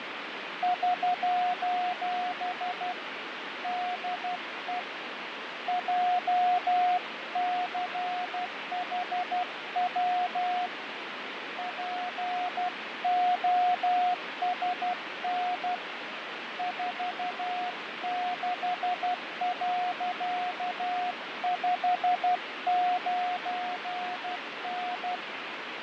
Morse code, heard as a keyed tone, hand-sent with a paddle, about 12 wpm, 720 Hz, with radio static and fading. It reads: <SOS> DE JCHW POSN 46.59N